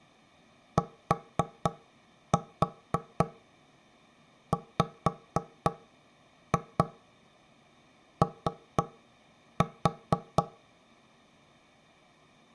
Tap code, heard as knocks on wood, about 4 knocks a second. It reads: TWO